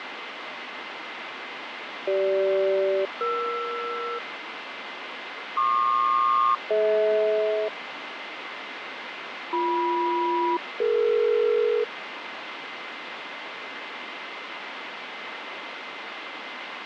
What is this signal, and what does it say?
Aircraft SELCAL, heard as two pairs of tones, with radio static and fading. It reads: CG-ER PQ-DH BM-DE